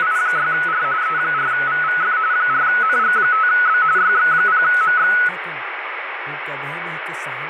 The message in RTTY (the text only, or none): … E4VVF 4NG5B YX0MX